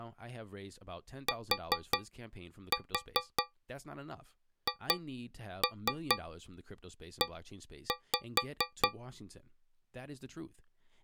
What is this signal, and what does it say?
Tap code, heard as taps on a metal pipe, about 4 knocks a second, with speech in English. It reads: THE